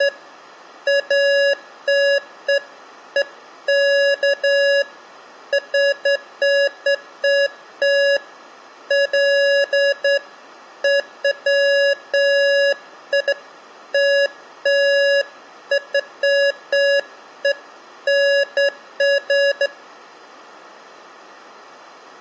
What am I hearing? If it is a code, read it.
Beeps of irregular length. There is no code.